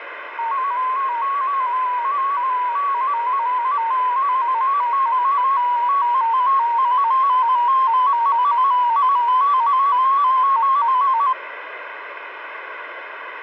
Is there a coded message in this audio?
Yes: multi-tone FSK (Olivia or MFSK type), about 250 Hz wide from 0.4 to 11.3 s, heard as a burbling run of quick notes, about 15.625 baud, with radio static.